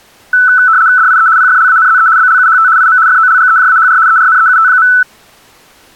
RTTY (75 baud, 170 Hz shift), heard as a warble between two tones, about 1410 Hz centre. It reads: DIE PFLANZE BLUHT IM FOLGEJAHR ERNEUT.